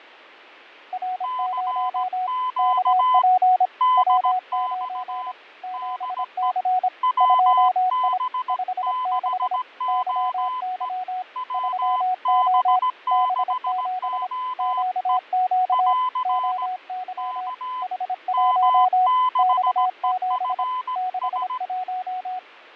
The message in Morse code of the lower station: R0 KP W9 7C 2I 56 YY 3O B7 QQ OY H1 X7 61

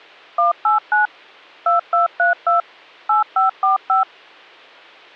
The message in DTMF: 189 2232 8545

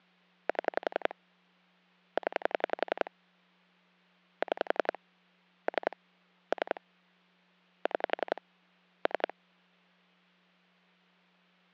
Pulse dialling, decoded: 7 0 6 3 3 6 3

